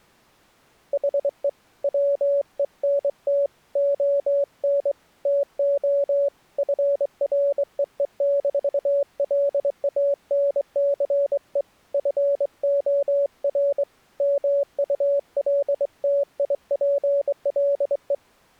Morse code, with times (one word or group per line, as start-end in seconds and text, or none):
0.9-1.5 HE
1.8-3.5 WENT
3.8-4.9 ON
5.3-6.3 TO
6.6-11.6 FREE-LANCE
11.9-13.8 FOR
14.2-18.1 MULTIPLE